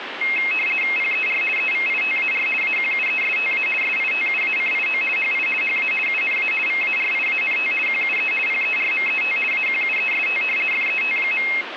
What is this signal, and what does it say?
RTTY (50 baud, 450 Hz shift), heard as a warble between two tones, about 2350 Hz centre, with radio static. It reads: PER EVITAR AQUESTA SITUACIO HI HA UNA VARIANT QUE PERMET AQUEST FET.